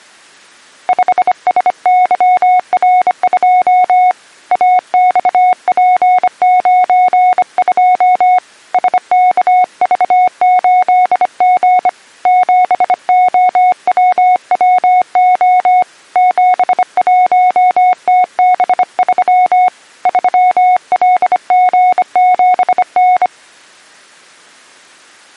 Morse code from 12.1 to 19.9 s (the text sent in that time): 7OWWO 71TB3